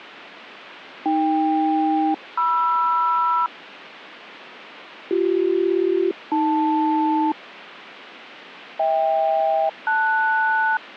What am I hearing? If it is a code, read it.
Aircraft SELCAL, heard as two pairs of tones. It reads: AK-MR BC-AL HK-LS